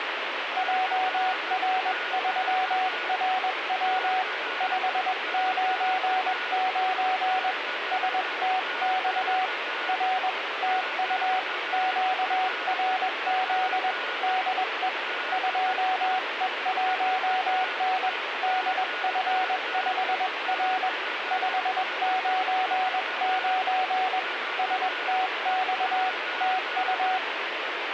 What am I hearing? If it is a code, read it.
Morse code, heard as a keyed tone, hand-sent with a paddle, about 21 wpm, 750 Hz, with radio static and a weaker station near 1450 Hz. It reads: JR3RW 599 STX R TU QRZ DE 2E1N DF5R 599 STX TU